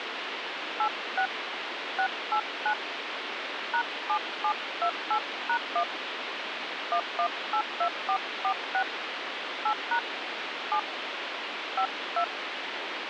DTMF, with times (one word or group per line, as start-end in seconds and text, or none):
0.8-1.3 86
2.0-2.7 689
3.7-5.8 #7728#1
6.9-8.8 1182446
9.7-10.0 8#
10.7-10.8 7
11.8-12.2 52